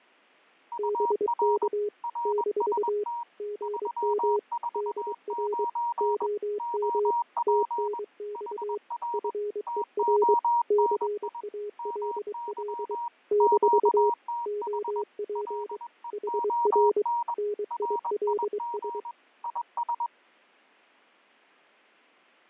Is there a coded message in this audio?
Yes: Morse code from 0.7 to 20.1 s, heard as two keyed tones, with fading. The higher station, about 21 wpm, 950 Hz: UR RST 349 OP HR TONI MY QTH LEON RIG IS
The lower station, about 23 wpm, 420 Hz: BK - GM DR OM TNX FER CALL - OP HR NILS